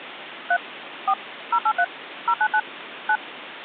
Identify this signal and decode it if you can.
DTMF, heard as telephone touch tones, dialled by machine, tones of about 60 ms, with phone line noise. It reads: 3 4 083 099 9